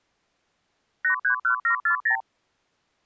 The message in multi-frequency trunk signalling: 831740

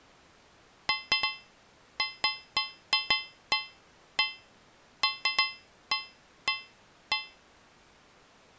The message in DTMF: none

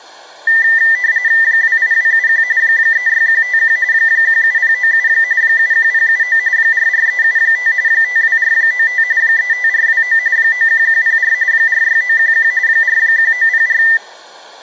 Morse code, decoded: none

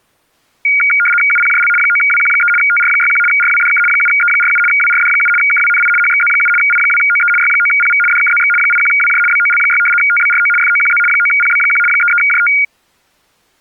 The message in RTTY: UPJL 9WQ3 TR61 RWDK 7E47 WRD7 KWNI HXZ7 I2OE Y9PV DKZX 81WJ BOL6 TBRO FOQZ 9PB1 33JT

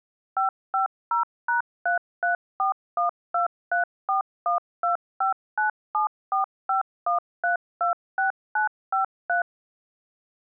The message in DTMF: 550#334123412597451326953

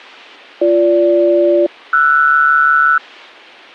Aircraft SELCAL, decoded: BG-RS

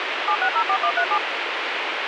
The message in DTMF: 7604137

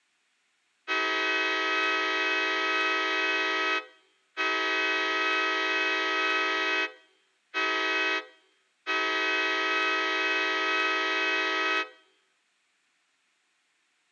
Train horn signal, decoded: 2 long, 1 short, 1 long

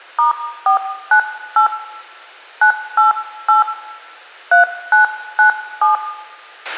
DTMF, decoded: *498 988 3997

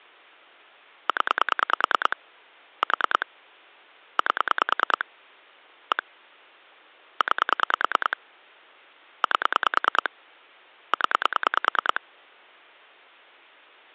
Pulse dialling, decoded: 0 4 8 1 9 8 0

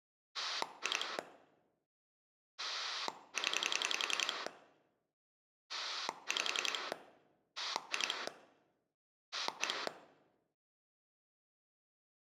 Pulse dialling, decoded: 2 0 5 2 1

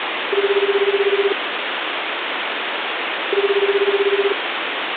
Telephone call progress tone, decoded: ringback tone

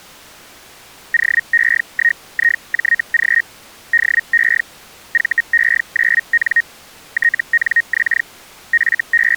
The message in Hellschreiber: OE1IJG DE VE9N TNX …

